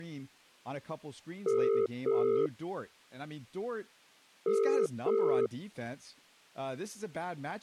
Telephone call progress tone (as in the UK, Ireland, Australia and similar networks), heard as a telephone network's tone, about 400, 450 Hz, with speech in English. Ringback tone.